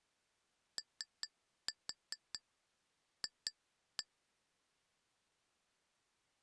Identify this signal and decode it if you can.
Tap code, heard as taps on glass, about 5 knocks a second. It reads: OF